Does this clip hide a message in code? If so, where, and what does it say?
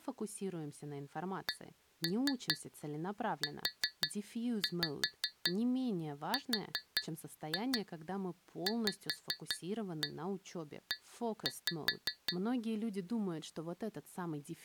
Yes: tap code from 1.5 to 12.4 s, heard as taps on glass, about 5 knocks a second, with speech in Russian. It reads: CURVE